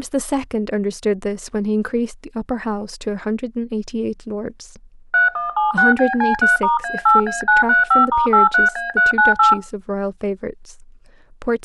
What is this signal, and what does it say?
DTMF, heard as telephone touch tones, dialled by machine, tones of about 150 ms, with speech in English. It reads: 3176BC3*A8A935*83A398